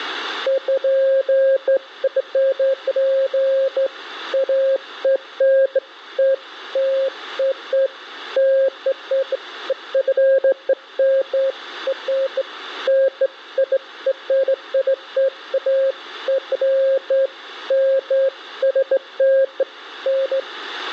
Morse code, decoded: none

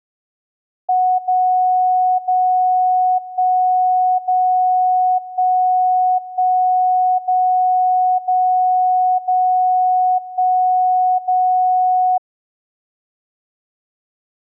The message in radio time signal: 0 0 1 0 1 1 0 0 0 1 0

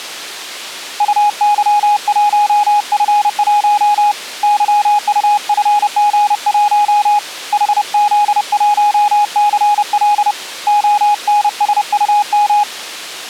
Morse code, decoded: UY1F1 YUFG1 HZ1CL ONSUM

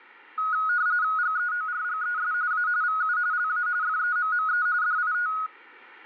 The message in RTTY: GEORGES A VU LA FEMME DIT

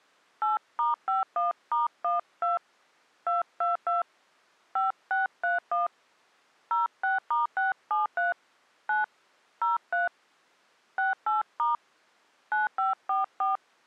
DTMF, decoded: 8*51*12 222 5631 06*673 9 03 68* 9544

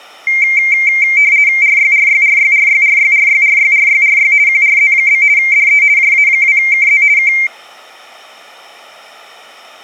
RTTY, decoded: RYRYRYRYRYRYRYRYRY QRZ? DE JA2KZ K

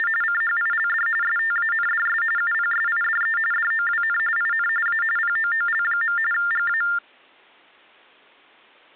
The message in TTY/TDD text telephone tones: … CHILD STANDS UPSIDE DOWN IN A POOL. GA

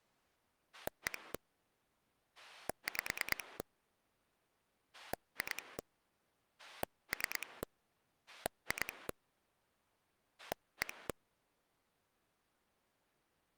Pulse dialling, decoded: 1 5 2 3 2 1

